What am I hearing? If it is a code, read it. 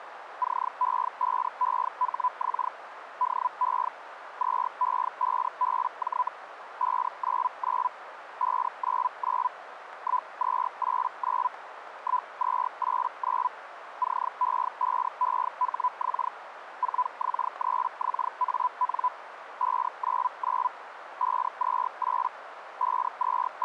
Hellschreiber (Feld-Hell, 122.5 baud), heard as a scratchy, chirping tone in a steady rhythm, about 1000 Hz, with radio static and a narrow filter. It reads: CE5EHX DE 2E5BJ 599 599 1289 1289 CE5EHX 4X3XAN 599 528 …